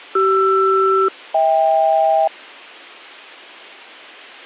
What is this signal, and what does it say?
Aircraft SELCAL, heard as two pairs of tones. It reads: CR-HK